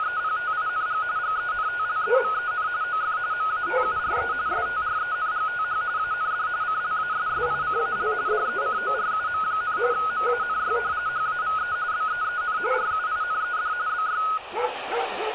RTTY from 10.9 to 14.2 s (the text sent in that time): HAVE BEEN RUINED BY